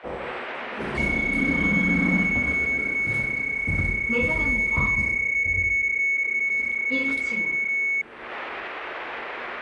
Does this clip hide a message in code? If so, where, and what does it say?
Yes: PSK31 (31.25 baud) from 1.0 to 8.0 s, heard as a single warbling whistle, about 2200 Hz, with the noise inside a lift.